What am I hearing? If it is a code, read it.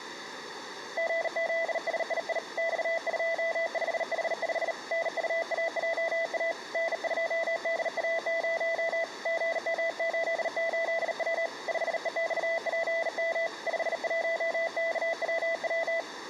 Morse code, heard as a keyed tone, hand-sent with a bug key, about 38 wpm, 660 Hz. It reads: GZSII X25H5 NUAJA N2DA0 GM88W 5EXPM 51KWW